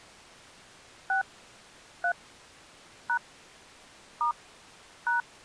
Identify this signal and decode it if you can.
DTMF, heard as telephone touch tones, dialled by hand, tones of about 110 ms. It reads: 6 3 # * #